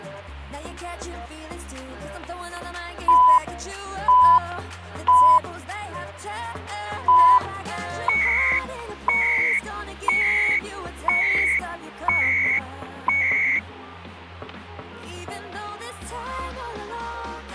Radio time signal (CHU, Canada), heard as beeps and data bursts, one a second, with static crashes.